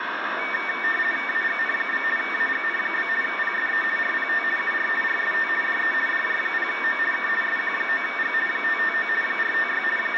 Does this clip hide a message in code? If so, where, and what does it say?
Yes: RTTY (50 baud, 450 Hz shift) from 0.4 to 10.2 s, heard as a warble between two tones, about 2050 Hz centre, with radio static and room echo. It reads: AGN? AGN? PSE RPT UR RST DE DJ0O K SQ9G 559 456 …